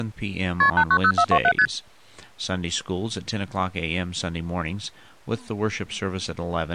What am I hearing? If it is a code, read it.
Multi-frequency trunk signalling (R1, as on North American trunks), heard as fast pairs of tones, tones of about 70 ms, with speech in English. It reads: KP 890427 ST